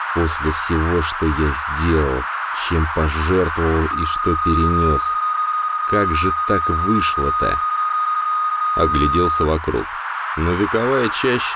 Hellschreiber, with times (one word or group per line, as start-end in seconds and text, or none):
none